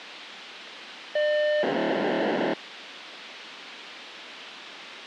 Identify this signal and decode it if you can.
POCSAG pager data (1200 baud), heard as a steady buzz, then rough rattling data, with radio hiss and a squelch burst at the end.